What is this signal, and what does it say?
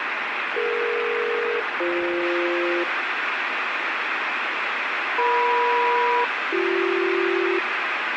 Aircraft SELCAL, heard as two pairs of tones, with radio static. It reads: DE-BF EM-BC